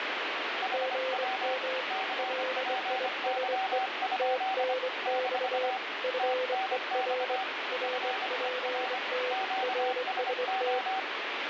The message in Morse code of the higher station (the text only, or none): HW CPY? - TNX FER QSO